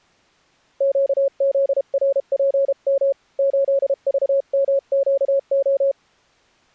Morse code, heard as a keyed tone, hand-sent with a paddle, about 32 wpm, 550 Hz. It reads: QZRPM 8VMQO